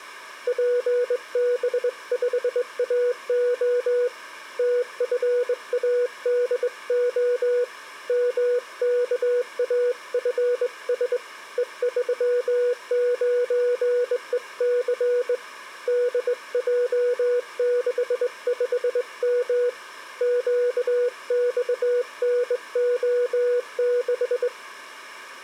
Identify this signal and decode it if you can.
Morse code, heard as a keyed tone, hand-sent with a straight key, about 21 wpm, 490 Hz. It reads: PB5AO TFADO MKAFS E39EC DJ65M QXNO6